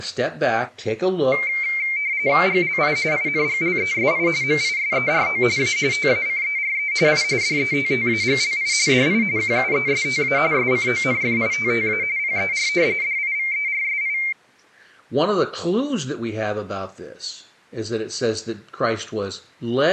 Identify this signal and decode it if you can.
RTTY (45.45 baud, 170 Hz shift), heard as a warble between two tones, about 2200 Hz centre. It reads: GLI INGLESI MISERO A TACERE I DETTAGLI DI QUESTA SCONFITTA PER DIVERSI